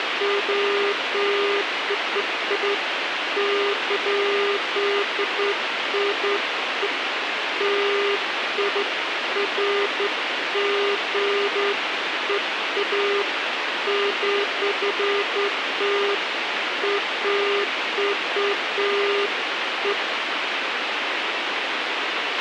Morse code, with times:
none

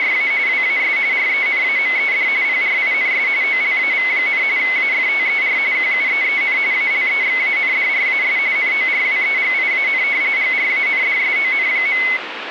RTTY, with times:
0.0-0.3 …
0.5-1.0 WAS
1.1-2.3 RENAMED
2.4-3.3 PRINS
3.4-4.4 OLAV,
4.6-5.6 AFTER
5.7-6.6 QUEEN
6.7-8.4 ALEXANDRAS
8.6-10.0 NORWEGIAN
10.4-12.0 GRANDSON.

